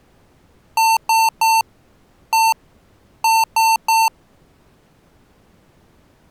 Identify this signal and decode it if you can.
Beep code, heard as beeps from a small speaker, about 900 Hz. 3-1-3. In Phoenix BIOS tables: interrupt mask register failure.